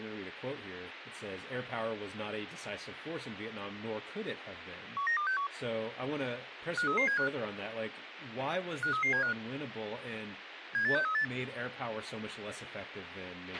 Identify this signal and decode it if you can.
Five-tone selective call (CCIR), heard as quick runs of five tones, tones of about 100 ms, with radio hiss, a squelch burst at the end and speech in English. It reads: 19261 53375 53375 78638